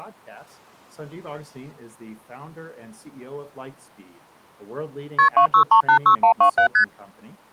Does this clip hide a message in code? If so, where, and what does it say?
Yes: multi-frequency trunk signalling (R1, as on North American trunks) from 5.2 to 6.8 s, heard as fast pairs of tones, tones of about 90 ms. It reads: KP 26386127 ST